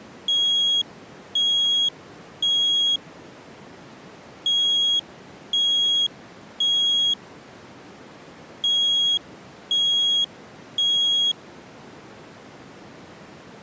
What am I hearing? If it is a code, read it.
Alarm pattern, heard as an alarm's beeps, played three times, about 3300 Hz. Temporal three. Smoke or fire, evacuate.